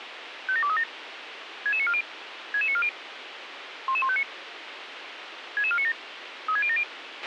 Five-tone selective call (ZVEI), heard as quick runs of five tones, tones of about 70 ms, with radio hiss and a squelch burst at the end. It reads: 57237 66940 66940 11159 66497 36070